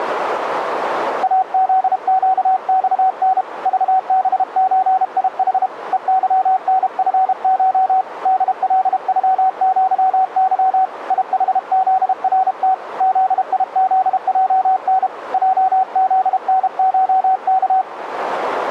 Morse code (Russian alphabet), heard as a keyed tone, hand-sent with a paddle, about 32 wpm, 760 Hz, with radio static. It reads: АЗЩЬН ЖБЧИХ ЕЫНФШ ДЛЮЪЫ ИХЗРТ ЗИЗЙН ЙЗНШК